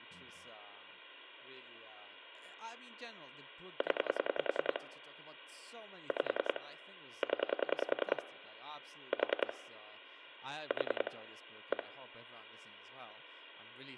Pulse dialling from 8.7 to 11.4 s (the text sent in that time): 4 4